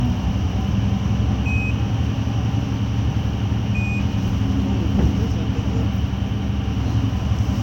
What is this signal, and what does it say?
Quindar tones, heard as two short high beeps, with radio hiss, room echo and the noise inside a bus.